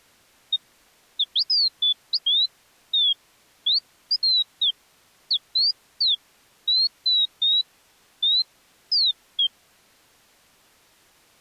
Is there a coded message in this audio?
No, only bird-like chirps.